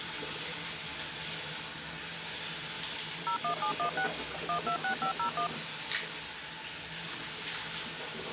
DTMF, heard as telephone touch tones, dialled by machine, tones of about 100 ms, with the noise of a restroom. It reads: 01716 126501